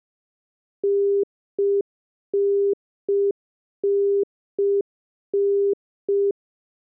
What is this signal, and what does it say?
Telephone call progress tone (UK plan), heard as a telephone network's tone, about 400 Hz. Congestion tone.